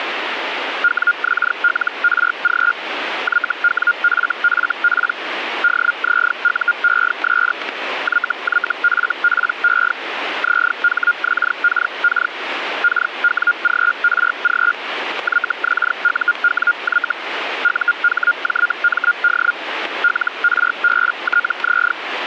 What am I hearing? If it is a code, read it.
Hellschreiber (Feld-Hell, 122.5 baud), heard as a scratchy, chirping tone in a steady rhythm, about 1420 Hz, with radio static. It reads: WXLRG YWFFP DZUES YYFPE ZHXKK KWGRG YXUWY UHJMD LRBTZ